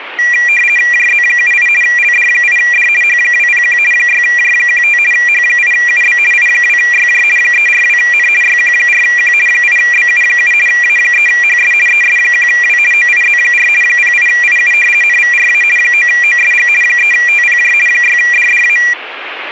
RTTY (50 baud, 450 Hz shift), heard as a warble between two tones, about 2150 Hz centre, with radio static. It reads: JZ78 LD8D H201 6J15 H8UB I2YJ 342N YQ4Q 8BU7 A3HS ES1W OIZ4 08IU NVRA 9OSG 3TPJ 6DDA